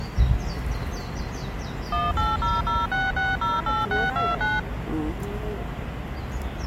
DTMF, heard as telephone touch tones, dialled by machine, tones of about 190 ms, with the noise of a park. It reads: 18006608629